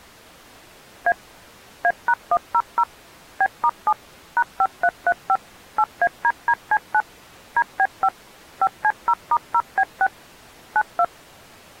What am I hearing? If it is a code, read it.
DTMF, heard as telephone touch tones, dialled by machine, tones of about 60 ms. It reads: A A#100 B*7 #5335 8ADDC9 DB5 5C0*0B6 92